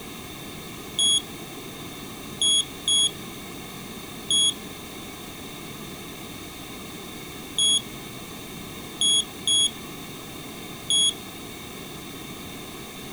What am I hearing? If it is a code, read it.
Beep code, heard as a piezo beeper, played twice, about 3350 Hz. 1-2-1. In Phoenix BIOS tables: interval timer failure.